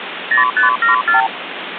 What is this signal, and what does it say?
Multi-frequency trunk signalling (R2, with the far end's replies), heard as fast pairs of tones, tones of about 130 ms, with phone line noise. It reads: 0574